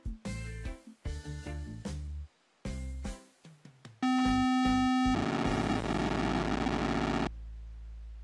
POCSAG pager data (512 baud), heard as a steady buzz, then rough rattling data.